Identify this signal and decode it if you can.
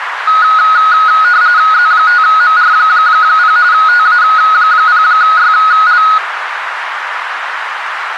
RTTY (45.45 baud, 170 Hz shift), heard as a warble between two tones, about 1360 Hz centre, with radio static and a narrow filter. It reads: Z5MR0 TA0YL